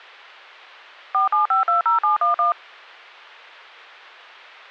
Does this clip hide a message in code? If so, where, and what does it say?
Yes: DTMF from 1.1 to 2.5 s, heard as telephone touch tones, dialled by machine, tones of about 130 ms. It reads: 47520711